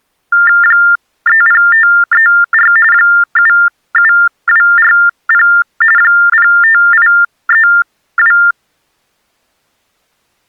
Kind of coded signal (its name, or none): TTY/TDD text telephone tones